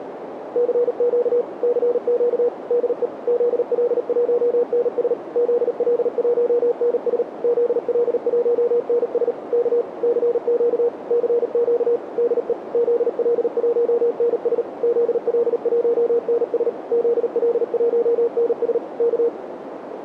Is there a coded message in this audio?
Yes: Morse code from 0.5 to 19.3 s, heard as a keyed tone, machine-sent, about 38 wpm, 480 Hz, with radio static and a narrow filter. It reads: CQ CQ DE ZL1NS ZL1NS ZL1NS K CQ CQ DE ZL1NS ZL1NS ZL1NS K